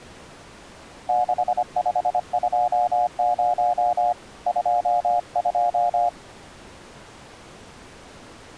Morse code, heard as a keyed tone, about 25 wpm, 720 Hz. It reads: 6520 22